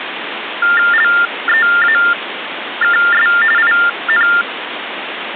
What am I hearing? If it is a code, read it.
TTY/TDD text telephone tones (45.45 baud Baudot), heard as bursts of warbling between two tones, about 400 Hz shift, 1600 Hz centre, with phone line noise. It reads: LEAKS IN